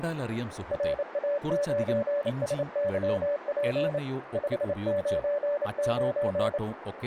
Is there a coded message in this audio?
Yes: Morse code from 0.7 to 6.6 s, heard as a keyed tone, hand-sent with a paddle, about 28 wpm, 580 Hz, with radio static, a narrow filter and speech in Malayalam. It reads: RA9SYP 599